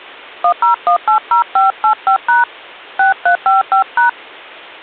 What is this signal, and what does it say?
DTMF, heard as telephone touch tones, dialled by hand, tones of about 120 ms. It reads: 10180585# 6355#